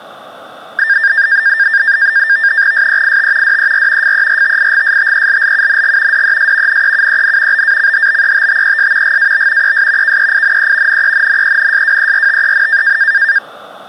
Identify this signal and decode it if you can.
NAVTEX (SITOR-B), 100 baud, 170 Hz shift, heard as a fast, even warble, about 1700 Hz centre. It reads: SEIT DER FERTIGSTELLUNG DES NEUEN BACHBETTES GAB ES KEINE NENNENSWERTEN